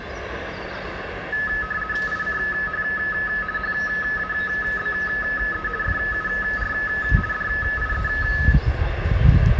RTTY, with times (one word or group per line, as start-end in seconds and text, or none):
2.1-2.8 ICH
3.6-5.7 HABE
5.8-6.7 FUR
7.3-8.1 DIE